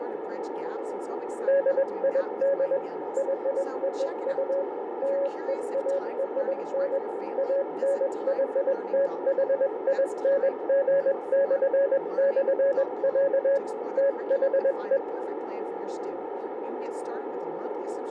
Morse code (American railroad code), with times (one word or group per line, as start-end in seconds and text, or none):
1.5-2.8 DID
3.2-4.6 YOU
5.0-7.0 LEARN
7.4-13.6 ANYTHING??,
14.0-15.0 THE